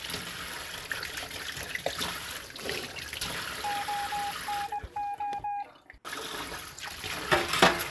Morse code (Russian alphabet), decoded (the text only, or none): ОНО